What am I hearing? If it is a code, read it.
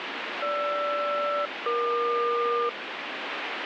Aircraft SELCAL, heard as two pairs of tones, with radio static. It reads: GR-EQ